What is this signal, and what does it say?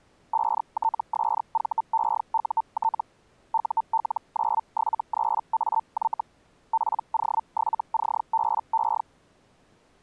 Hellschreiber (Feld-Hell, 122.5 baud), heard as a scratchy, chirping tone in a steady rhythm, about 900 Hz. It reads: 5TSVEUT UL973AY PO7CBE